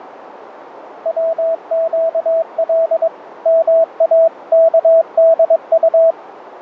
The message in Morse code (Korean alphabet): 백 모의

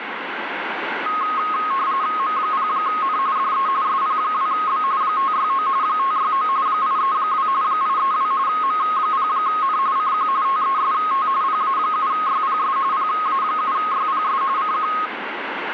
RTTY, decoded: M0N DE SP2B 569 569 832 832 M0N CQ TEST PA7YPS PA7YPS CQ

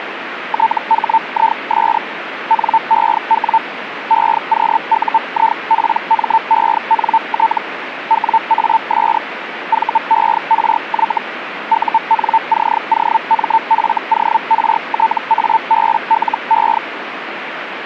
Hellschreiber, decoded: THIS NEW EQUIPMENT WAS VERY UNCOMFORTABLE

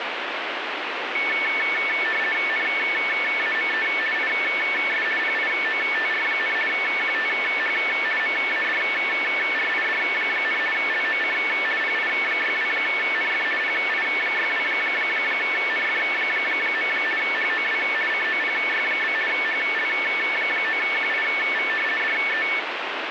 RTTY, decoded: NAME IS PIOTR, QTH MADRID, LOC PI62NF PI62NF. HOW COPY? HL9QIV DE

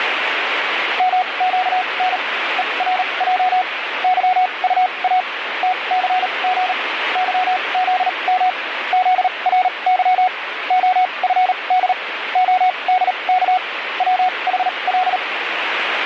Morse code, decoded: MQN ERJ YUA TCG YZM ZRY OFD ODK WHL

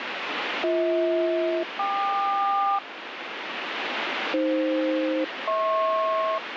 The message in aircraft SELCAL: BH-KQ AF-HP

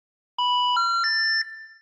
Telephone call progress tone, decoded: special information tone

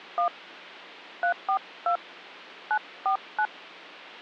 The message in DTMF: 1 342 949

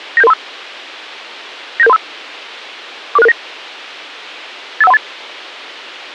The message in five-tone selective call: 97735 97735 44669 85138

